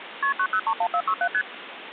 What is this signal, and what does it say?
Multi-frequency trunk signalling (R1, as on North American trunks), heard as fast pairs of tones, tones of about 70 ms, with phone line noise. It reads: KP 9031467 ST